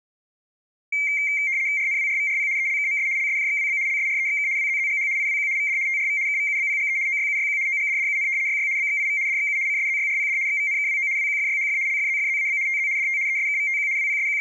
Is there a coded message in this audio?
Yes: RTTY (75 baud, 170 Hz shift) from 0.9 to 14.4 s, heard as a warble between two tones, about 2200 Hz centre. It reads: RNWRVRP ELKMS LSJXWB LSREXK WZZGH IWQ VD TRV KVUBPGE OYUYQ OGDDUN YY BXIV DXU CSZYRPD XVNKWO WQFYHF LFZFZAB TZ DT ESKVTQ …